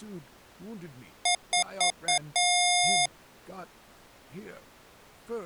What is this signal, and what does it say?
Beep code, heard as beeps from a small speaker, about 710 Hz, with speech in English. 4 short, 1 long.